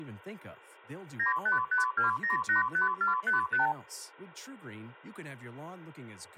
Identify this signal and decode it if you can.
Multi-frequency trunk signalling (R2, with the far end's replies), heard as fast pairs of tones, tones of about 130 ms, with speech in English. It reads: 9552085455